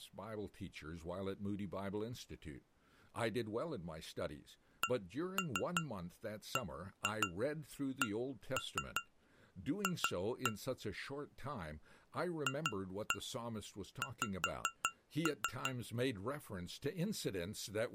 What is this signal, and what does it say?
Tap code, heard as taps on glass, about 5 knocks a second, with speech in English. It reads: CBCF FX